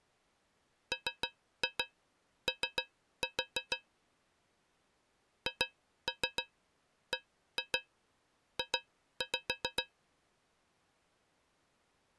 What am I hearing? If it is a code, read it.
Tap code, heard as taps on a metal pipe, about 6 knocks a second. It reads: MO HBJ